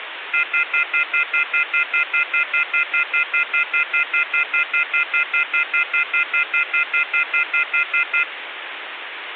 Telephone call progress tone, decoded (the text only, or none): off-hook warning tone